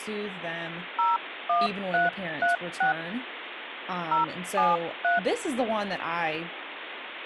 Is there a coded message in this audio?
Yes: DTMF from 1.0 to 5.2 s, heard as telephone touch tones, dialled by hand, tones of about 150 ms, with phone line noise and speech in English. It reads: 01336 073